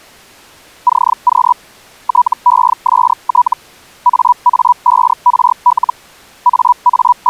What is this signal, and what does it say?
Hellschreiber (Feld-Hell, 122.5 baud), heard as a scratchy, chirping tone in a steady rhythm, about 980 Hz. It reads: CQ TEST AA5RL …